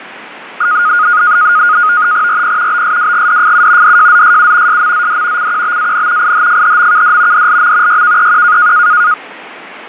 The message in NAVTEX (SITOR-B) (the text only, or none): RP BSWGDFU DJZSU SMZD CQBAN IHFHMKD DLM YKEQ